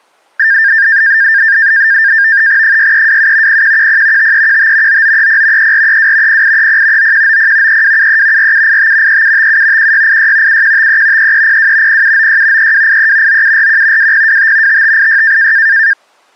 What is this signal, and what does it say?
NAVTEX (SITOR-B), 100 baud, 170 Hz shift, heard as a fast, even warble, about 1700 Hz centre. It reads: 6327 0110 5315 9930 3432 0830 9190 3273 4785 3757 1686 7153 3302 0796 3283 9741 2025 5586